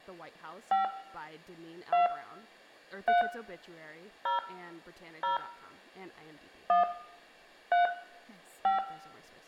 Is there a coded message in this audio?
Yes: DTMF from 0.7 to 8.8 s, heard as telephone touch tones, dialled by hand, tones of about 140 ms, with room echo and speech in English. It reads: 5 2 3 0 0 1 3 5